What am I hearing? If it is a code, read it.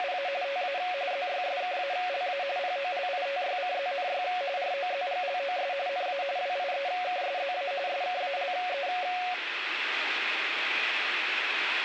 RTTY (45.45 baud, 170 Hz shift), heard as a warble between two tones, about 640 Hz centre, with radio static. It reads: … TA ZYSKALA POLITYCZNY ROZGLOS NA WIEKSZA SKALE